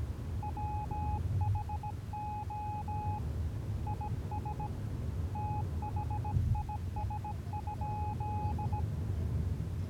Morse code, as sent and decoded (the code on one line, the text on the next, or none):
.-- .... --- / .. ... / - .... .. ... ..--..
WHO IS THIS?